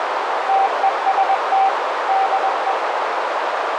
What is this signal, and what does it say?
Morse code, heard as a keyed tone, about 21 wpm, 780 Hz, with heavy radio static and a narrow filter. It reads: TEST DE